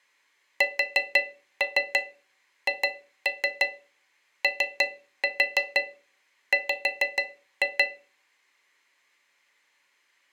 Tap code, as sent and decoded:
4-3 2-3 3-4 5-2
SHOW

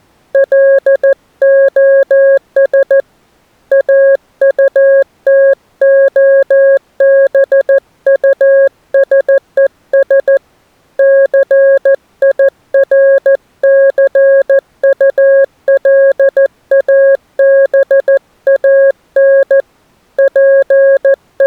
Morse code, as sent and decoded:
.-.. --- ... / .- ..- - --- -... ..- ... . ... / -.-. .. .-. -.-. ..- .-.. .- -... .- -. / …
LOS AUTOBUSES CIRCULABAN …

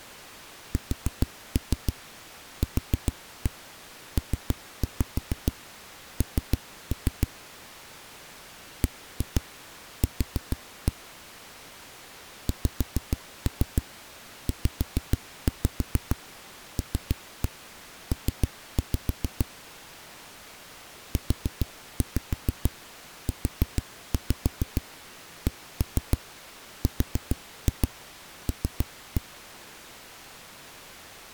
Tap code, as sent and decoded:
4-3 4-1 3-5 3-3 / 1-2 4-1 / 5-3 5-5 3-1 3-5 / 4-5 4-5 1-3 4-2 3-1
SQPN BQ XZLP UUCRL

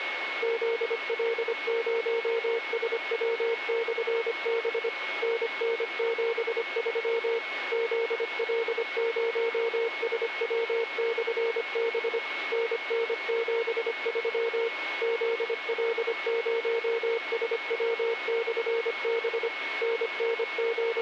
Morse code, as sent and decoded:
--.. .-.. ----- ... .-- -..-. -... / -. -. --... ...-- / --.. .-.. ----- ... .-- -..-. -... / -. -. --... ...-- / --.. .-.. ----- ... .-- -..-. -... / …
ZL0SW/B NN73 ZL0SW/B NN73 ZL0SW/B …

